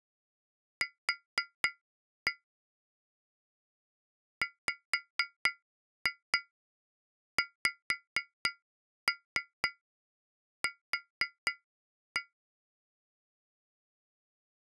Tap code, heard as taps on glass, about 4 knocks a second. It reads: Q WXQ